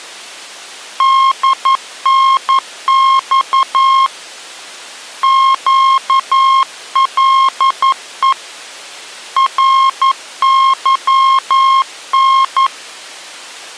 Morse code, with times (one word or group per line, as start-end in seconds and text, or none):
1.0-4.1 DNX
5.2-8.3 QLE
9.4-12.7 RYN